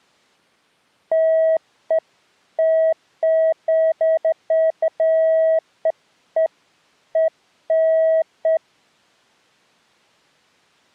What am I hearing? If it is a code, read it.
Beeps of irregular length. There is no code.